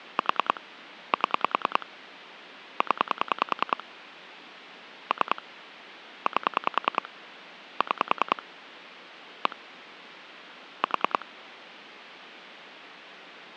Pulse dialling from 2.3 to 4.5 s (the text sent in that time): 0